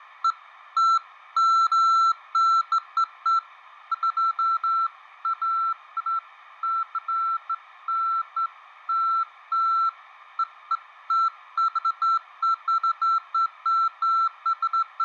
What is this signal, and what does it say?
Beeps of irregular length, with fading. There is no code.